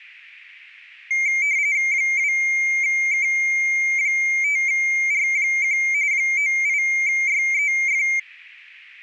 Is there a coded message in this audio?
Yes: RTTY (45.45 baud, 170 Hz shift) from 1.1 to 8.2 s, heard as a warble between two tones, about 2200 Hz centre. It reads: 2K5R1 98YEF